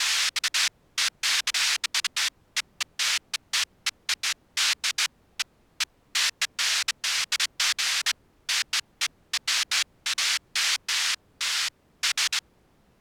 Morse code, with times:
none

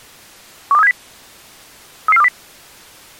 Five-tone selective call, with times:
0.7-0.9 12370
2.1-2.3 33420

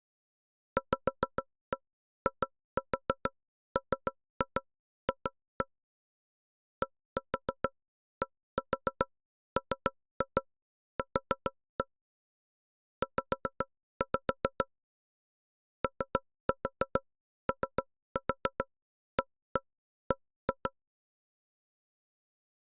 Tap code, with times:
0.8-5.7 VIMF
6.8-11.8 DDMQ
13.0-14.7 Z
15.8-20.7 OOAB

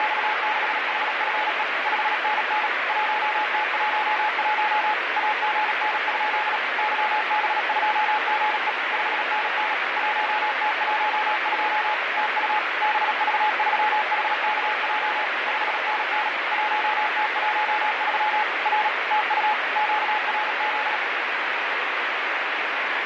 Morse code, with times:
0.0-1.6 …
1.9-2.7 5NN
2.9-4.9 1T11
5.2-6.6 AGN?
6.8-8.7 YB2GE
8.9-9.7 5NN
10.0-11.9 1T12
12.2-12.6 TU
12.8-15.3 BV3HKJ
15.5-16.3 5NN
16.5-18.4 1T13
18.7-18.9 R
19.1-19.5 TU
19.8-21.0 QRZ

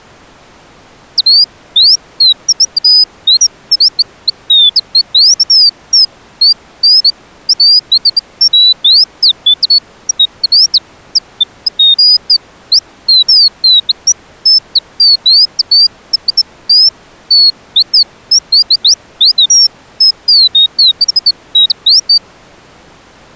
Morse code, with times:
none

